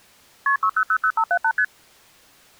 Multi-frequency trunk signalling (R1, as on North American trunks), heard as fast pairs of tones, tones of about 70 ms. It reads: KP 6000578 ST